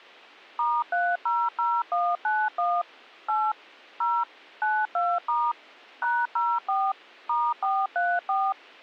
DTMF, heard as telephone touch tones, dialled by machine, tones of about 240 ms. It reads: *300191 8 0 92* #04 *434